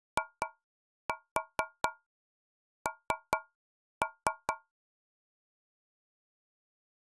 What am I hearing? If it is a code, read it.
Tap code, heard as taps on a metal pipe, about 4 knocks a second. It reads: IN